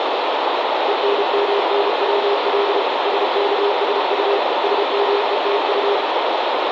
Morse code, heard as a keyed tone, machine-sent, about 32 wpm, 400 Hz, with heavy radio static. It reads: ENMNWL SKSU SMETU